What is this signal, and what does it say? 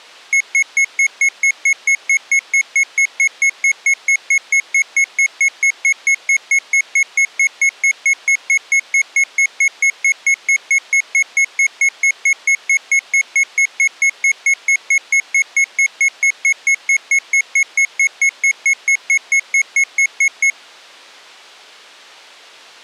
Evenly repeated beeps. There is no code.